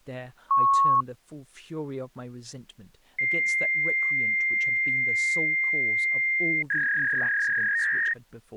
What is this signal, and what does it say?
Fax machine handshake, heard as a beep, a long tone and a warble, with speech in English.